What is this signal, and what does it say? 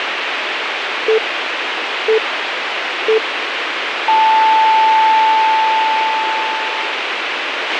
Radio time signal (three low pips and a long one an octave up, as on NHK), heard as pips, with radio hiss and a squelch burst at the end.